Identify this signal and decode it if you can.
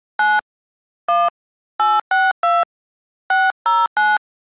DTMF, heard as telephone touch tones, dialled by hand, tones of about 200 ms. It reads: 9 1 862 609